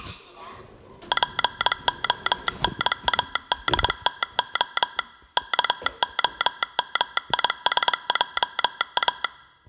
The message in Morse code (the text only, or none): PONADTO KOMISJA